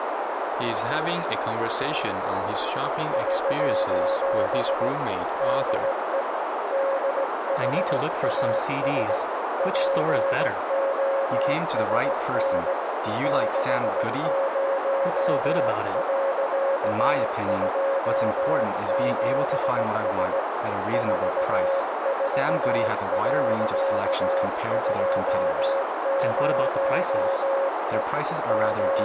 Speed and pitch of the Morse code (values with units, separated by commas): 17 wpm, 550 Hz